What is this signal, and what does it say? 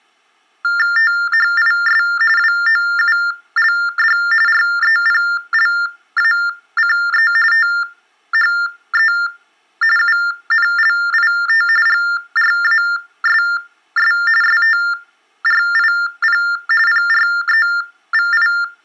TTY/TDD text telephone tones (45.45 baud Baudot), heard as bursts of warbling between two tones, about 400 Hz shift, 1600 Hz centre. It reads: THIS WOULD REPLACE THE UNLIT GRASS STRIP …